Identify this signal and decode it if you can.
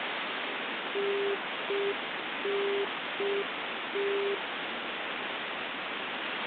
Telephone call progress tone (UK plan), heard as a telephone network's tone, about 400 Hz, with phone line noise. Congestion tone.